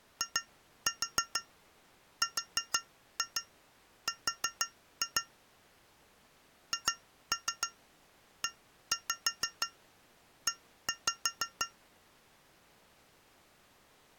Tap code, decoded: IRR HEE

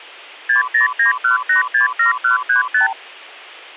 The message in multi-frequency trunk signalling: 6091867135

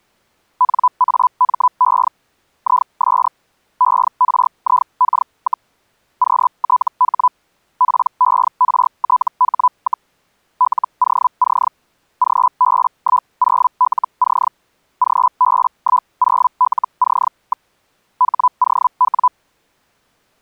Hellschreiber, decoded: NAME IS ERIK, QTH PERTH, LOC GB10LC GB10LC. HOW

